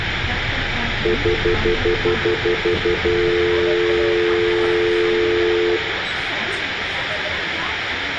Telephone call progress tone (North American plan), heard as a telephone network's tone, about 350, 440 Hz, 0.1 s on and 0.1 s off, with phone line noise, room echo and the noise inside a bus. Stutter dial tone.